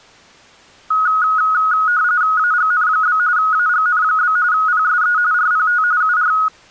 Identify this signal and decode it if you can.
RTTY (45.45 baud, 170 Hz shift), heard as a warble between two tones, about 1360 Hz centre. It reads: AGN? AGN? PSE RPT UR